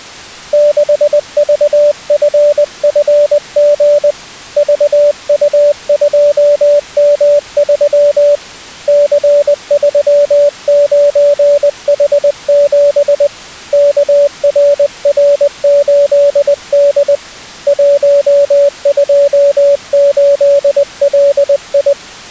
Morse code, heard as a keyed tone, hand-sent with a paddle, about 20 wpm, 580 Hz. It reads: 6VFFG VU2M3 C39H7 KRR8D 128LI